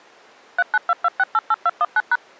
DTMF, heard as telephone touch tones, dialled by machine, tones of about 40 ms. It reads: 3922688219#